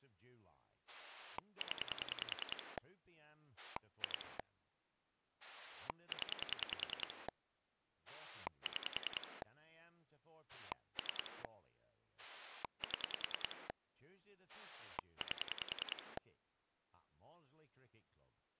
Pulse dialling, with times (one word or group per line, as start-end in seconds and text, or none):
0.9-2.8 0
3.6-4.4 2
5.4-7.3 0
8.1-9.4 6
10.5-11.4 3
12.2-13.7 7
14.5-16.2 8